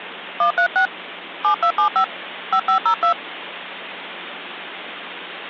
DTMF, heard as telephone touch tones, dialled by hand, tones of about 100 ms, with phone line noise. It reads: 136 7275 5502